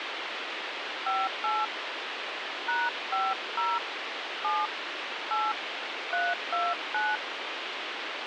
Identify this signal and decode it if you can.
DTMF, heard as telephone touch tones, dialled by hand, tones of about 210 ms, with radio hiss. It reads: 58 #50 7 8 329